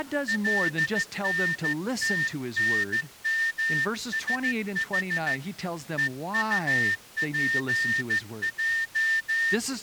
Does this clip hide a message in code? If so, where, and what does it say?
Yes: Morse code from 0.2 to 9.6 s, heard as a whistle, hand-sent with a straight key, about 14 wpm, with speech in English. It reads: LNTNMSH EUPJ